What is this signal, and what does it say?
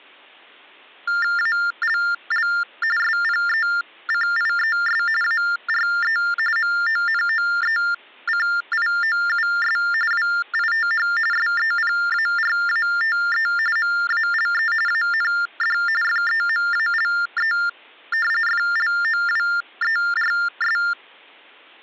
TTY/TDD text telephone tones (45.45 baud Baudot), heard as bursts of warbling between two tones, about 400 Hz shift, 1600 Hz centre. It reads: ALL SPECIES ARE MONOECIOUS WITH SEPARATE MALE AND FEMALE FLOWERS